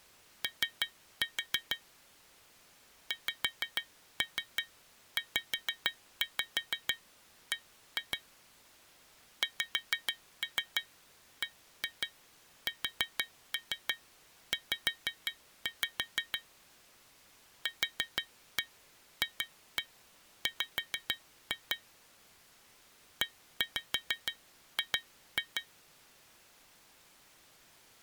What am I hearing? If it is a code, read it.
Tap code, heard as taps on glass, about 6 knocks a second. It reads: O XZB XBSZ QFW EG